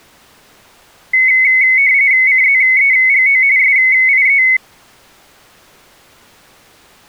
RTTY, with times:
2.3-3.4 CZEGO
3.6-4.4 SIE

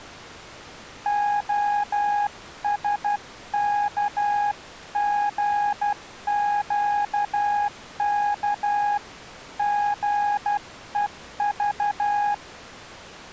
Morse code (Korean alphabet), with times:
1.1-9.0 평생
9.6-12.3 살

